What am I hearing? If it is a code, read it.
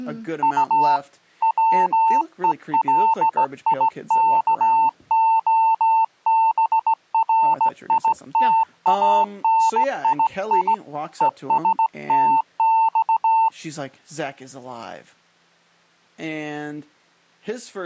Morse code (Russian alphabet), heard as a keyed tone, hand-sent with a straight key, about 17 wpm, 900 Hz, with speech in English. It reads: У ВЕЛИКОБРИТАНИИ ЕСТЬ